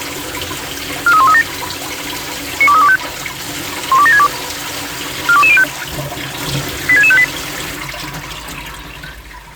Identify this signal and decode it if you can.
Five-tone selective call (ZVEI), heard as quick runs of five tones, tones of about 70 ms, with kitchen noise. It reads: 43137 92325 12762 42205 86658